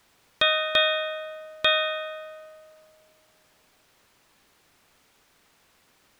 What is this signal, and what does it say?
Ship's bell, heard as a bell. 3. Three half-hours of the watch have passed.